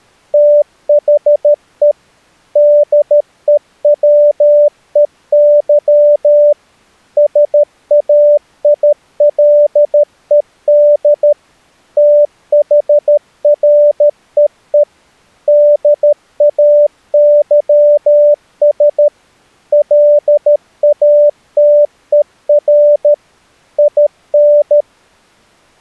Morse code, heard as a keyed tone, machine-sent, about 13 wpm, 590 Hz. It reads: THE DEWEY SAILED THREE DAYS LATER IN